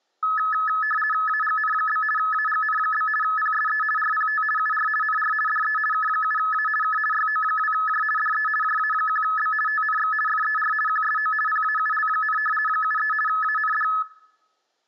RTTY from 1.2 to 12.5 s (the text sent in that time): AGN? AGN? PSE RPT UR NR DE K7A K YO2J DE JA1B TNX FER QSO PAUL,